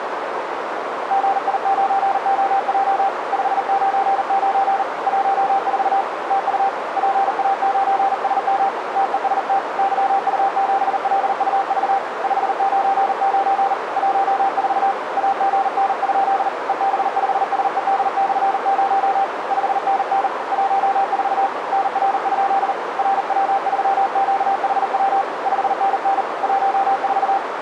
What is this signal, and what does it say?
Morse code, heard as a keyed tone, hand-sent with a paddle, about 39 wpm, 780 Hz, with radio static and a narrow filter. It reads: GI9OJ 599 14 TU PA9SM TEST YU7LUV 599 14 AGN? EB5SED/0 5NN 14 NR? RW3QHW 5NN 14